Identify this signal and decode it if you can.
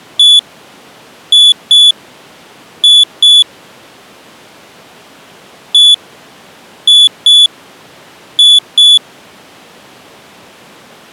Beep code, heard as a piezo beeper, played twice, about 3450 Hz. 1-2-2. In Phoenix BIOS tables: DMA initialisation failure.